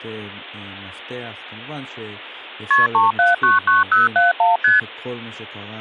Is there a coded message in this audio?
Yes: multi-frequency trunk signalling (R1, as on North American trunks) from 2.7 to 4.8 s, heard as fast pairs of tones, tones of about 160 ms, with speech in Hebrew. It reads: KP 3799071 ST